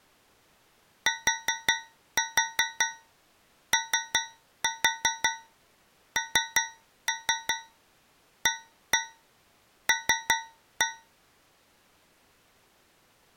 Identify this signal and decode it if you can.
Tap code, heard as taps on a metal pipe, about 5 knocks a second. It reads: TONAL